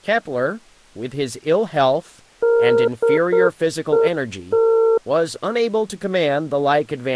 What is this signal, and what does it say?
Morse code, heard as a keyed tone, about 8 wpm, 460 Hz, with speech in English. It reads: DET